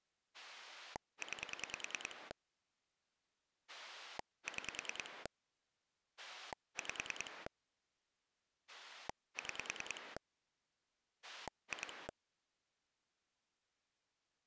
Pulse dialling, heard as a rotary dial, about 10 pulses a second. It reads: 9 6 5 6 2